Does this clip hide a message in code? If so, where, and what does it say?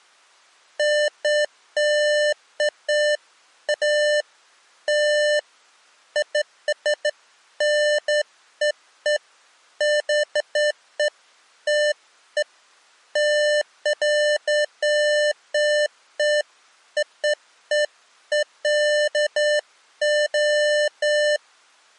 No, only beeps of irregular length.